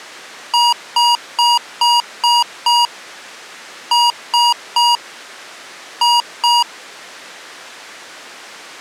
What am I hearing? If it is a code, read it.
Beep code, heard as beeps from a small speaker, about 950 Hz. 6-3-2.